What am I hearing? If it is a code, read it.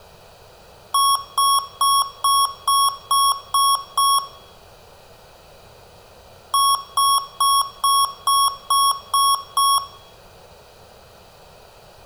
Beep code, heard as beeps from a small speaker, played twice, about 1110 Hz, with room echo. 8 short. In AMI BIOS tables: display memory failure; in Dell tables: LCD failure.